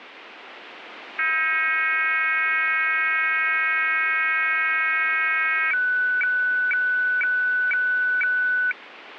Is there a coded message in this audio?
Yes: weather fax (radiofax), 120 lines a minute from 1.2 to 8.7 s, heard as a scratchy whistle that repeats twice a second.